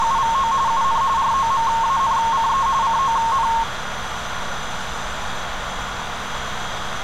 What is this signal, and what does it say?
RTTY (45.45 baud, 170 Hz shift), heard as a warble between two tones, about 1000 Hz centre, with radio static, a narrow filter and street noise. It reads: … UN ROMANCE CON